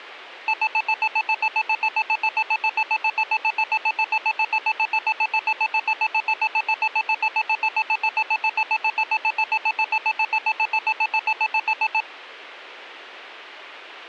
Evenly repeated beeps. There is no code.